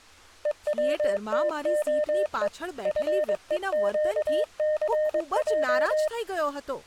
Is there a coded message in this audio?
Yes: Morse code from 0.4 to 6.1 s, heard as a keyed tone, machine-sent, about 22 wpm, 610 Hz, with speech in Gujarati. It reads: EWTOE FEQCJ